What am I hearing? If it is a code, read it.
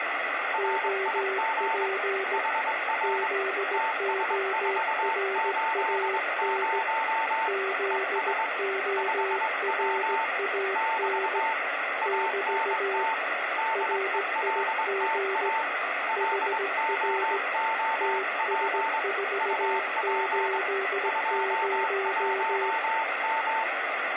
Morse code, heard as two keyed tones, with radio static. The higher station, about 22 wpm, 890 Hz: RIG HR TS480 ES 5W <BT> ANT DELTA LOOP UP 21M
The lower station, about 17 wpm, 390 Hz: OP ZORAN ZORAN <BT> RIG HR TS480